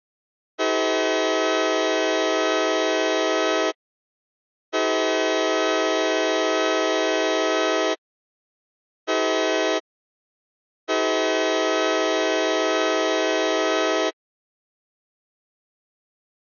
Train horn signal, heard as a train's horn. 2 long, 1 short, 1 long. On North American railways: approaching a public crossing.